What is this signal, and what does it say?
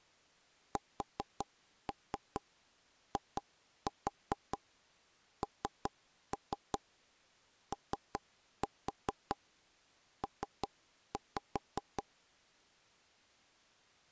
Tap code, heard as taps on a table, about 5 knocks a second. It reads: SINOP